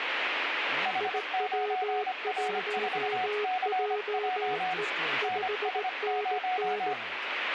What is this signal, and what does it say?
Morse code, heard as two keyed tones, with radio static. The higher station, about 25 wpm, 740 Hz: H9R4CJ NS0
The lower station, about 18 wpm, 420 Hz: IW1JE 5NN